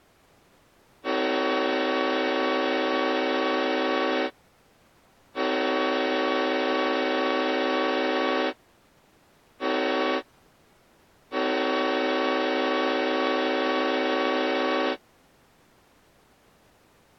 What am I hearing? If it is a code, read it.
Train horn signal, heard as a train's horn. 2 long, 1 short, 1 long. On North American railways: approaching a public crossing.